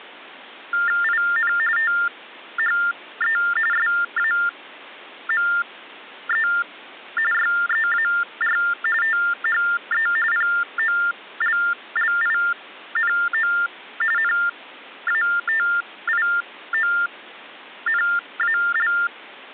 TTY/TDD text telephone tones (45.45 baud Baudot), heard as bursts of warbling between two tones, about 400 Hz shift, 1600 Hz centre. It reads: IN THE SAME YEAR THE POLLINO NATIONAL